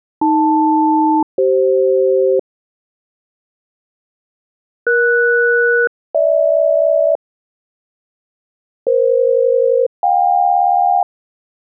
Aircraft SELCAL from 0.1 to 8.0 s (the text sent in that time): AL-CF ES-GH